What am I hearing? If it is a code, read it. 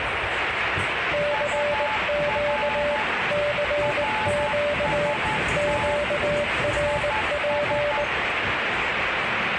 Morse code, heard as two keyed tones, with radio static and the noise inside a subway train. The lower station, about 19 wpm, 590 Hz: CQ CQ QRP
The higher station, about 12 wpm, 860 Hz: UR RST IS